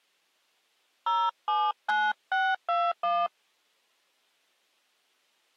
DTMF, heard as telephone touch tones, dialled by hand, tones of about 230 ms. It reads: 079621